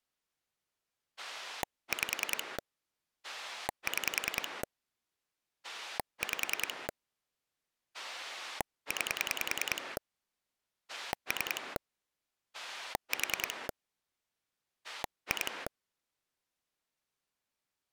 Pulse dialling, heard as a rotary dial, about 10 pulses a second. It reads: 5 6 5 9 3 4 2